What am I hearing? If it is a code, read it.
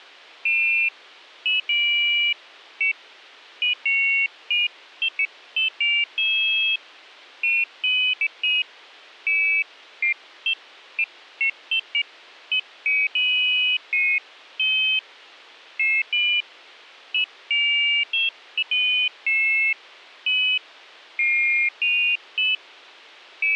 Pairs of high tones at irregular times. There is no code.